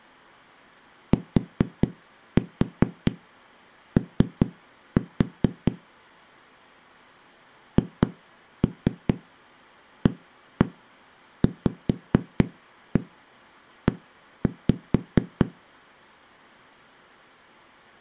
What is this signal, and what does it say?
Tap code, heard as knocks on a wall, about 4 knocks a second. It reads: TO HAVE